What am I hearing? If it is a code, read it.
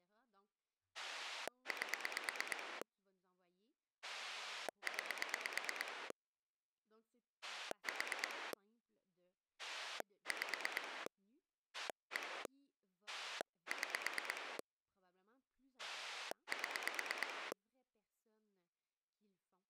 Pulse dialling, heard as a rotary dial, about 8 pulses a second, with speech in French. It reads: 8 9 4 5 1 6 7